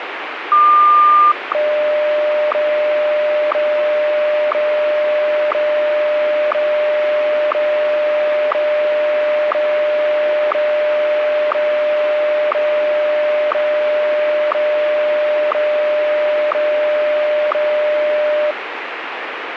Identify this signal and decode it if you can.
Radio time signal (WWVH, Hawaii), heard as ticks, one a second, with radio static.